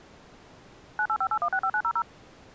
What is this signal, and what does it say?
DTMF, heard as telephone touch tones, dialled by machine, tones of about 70 ms. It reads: 9858165900